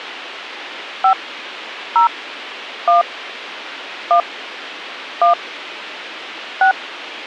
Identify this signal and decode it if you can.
DTMF, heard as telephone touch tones, dialled by hand, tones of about 120 ms, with radio hiss. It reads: 5 0 1 1 1 6